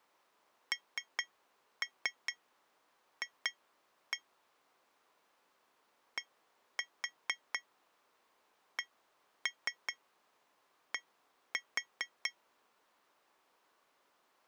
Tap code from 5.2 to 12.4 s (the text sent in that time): DCD